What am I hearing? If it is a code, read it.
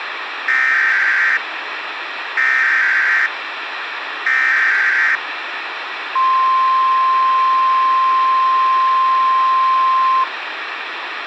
Emergency Alert System (SAME) tones (header bursts, then the 1050 Hz attention tone), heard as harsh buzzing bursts, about 520.83 baud, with radio hiss.